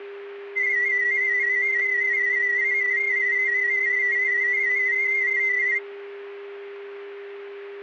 Multi-tone FSK (Olivia or MFSK type), about 250 Hz wide, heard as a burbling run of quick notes, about 31.25 baud, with a steady whistle near 400 Hz.